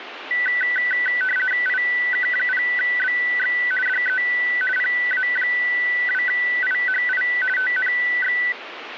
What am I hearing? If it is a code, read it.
RTTY (50 baud, 450 Hz shift), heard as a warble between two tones, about 1750 Hz centre, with radio static. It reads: IK0BX DE PA2IHI TNX